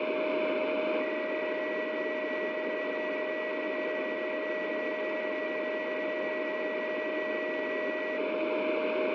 PSK31 (31.25 baud), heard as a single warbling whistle, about 1950 Hz, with radio static and a steady whistle near 620 Hz.